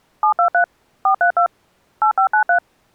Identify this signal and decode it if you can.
DTMF, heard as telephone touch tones, dialled by machine, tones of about 100 ms. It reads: 723 432 8593